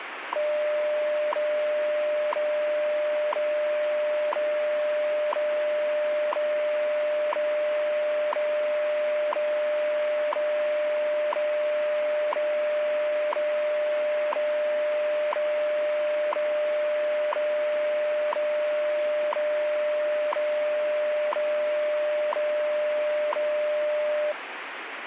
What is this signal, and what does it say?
Radio time signal (WWV, Colorado), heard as ticks, one a second, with radio static.